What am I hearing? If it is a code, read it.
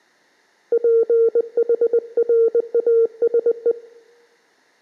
Morse code, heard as a keyed tone, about 20 wpm, 460 Hz. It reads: PHRASE